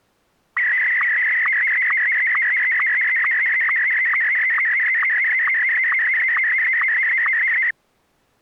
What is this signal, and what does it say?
SSTV (slow-scan television), Martin M1, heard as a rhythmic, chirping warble.